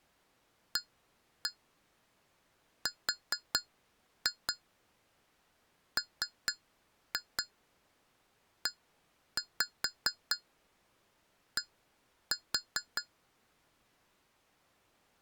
Tap code, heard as taps on glass, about 4 knocks a second. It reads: ARMED